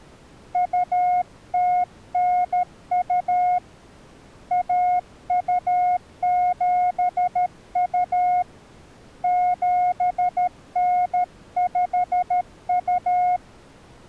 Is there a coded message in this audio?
Yes: Morse code (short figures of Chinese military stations) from 0.5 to 13.4 s, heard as a keyed tone, hand-sent with a paddle, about 13 wpm, 720 Hz. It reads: 2092 1272 7952